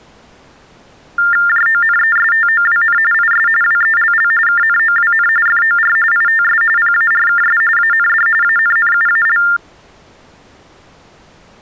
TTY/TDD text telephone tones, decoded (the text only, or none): JONESTOWN IS WELL KNOWN FOR ITS PARKS AND ANNUAL